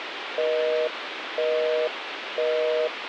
Telephone call progress tone (North American plan), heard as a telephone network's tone, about 480, 620 Hz, 0.5 s on and 0.5 s off, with phone line noise. Busy tone.